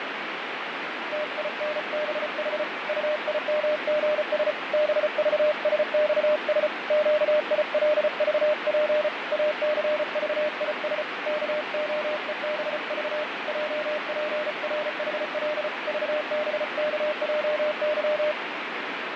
Morse code, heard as a keyed tone, hand-sent with a paddle, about 34 wpm, 600 Hz, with radio static and fading. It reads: TINBH UIMGS BVSXS QILVP ACVIS KOEBV JPRHL VBKJY